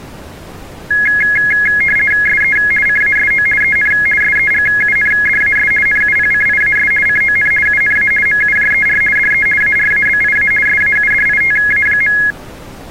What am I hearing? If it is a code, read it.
RTTY (50 baud, 450 Hz shift), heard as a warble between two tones, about 1900 Hz centre. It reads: SE CASO EN SEGUNDAS NUPCIAS CON UNA MUJER DE ARABIA SAUDITA.